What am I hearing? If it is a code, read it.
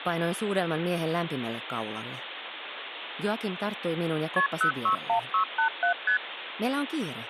Multi-frequency trunk signalling (R1, as on North American trunks), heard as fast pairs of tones, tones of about 100 ms, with phone line noise. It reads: KP 061687 ST